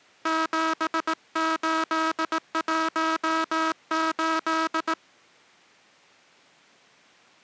Morse code, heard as a buzzer, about 18 wpm. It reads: 7818